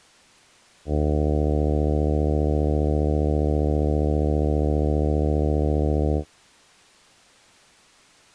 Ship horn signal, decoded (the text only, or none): 1 long